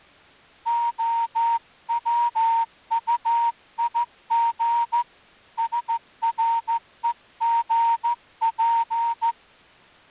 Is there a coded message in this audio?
Yes: Morse code (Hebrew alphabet) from 0.6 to 9.4 s, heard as a whistle, hand-sent with a straight key, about 14 wpm. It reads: הצטיג שרוגף